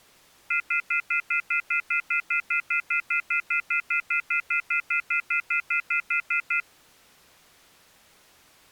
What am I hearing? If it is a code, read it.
Telephone call progress tone (North American plan), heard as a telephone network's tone, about 1400, 2050, 2450, 2600 Hz, 0.1 s on and 0.1 s off. Off-hook warning tone.